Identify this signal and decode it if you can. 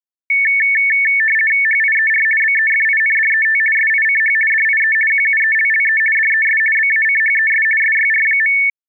RTTY (50 baud, 450 Hz shift), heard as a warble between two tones, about 2000 Hz centre. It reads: HIER BEFINDET SICH DIE QUELLE DES BACHES SYR.